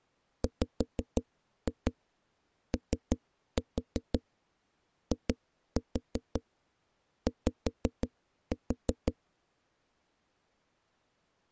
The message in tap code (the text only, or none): WOIY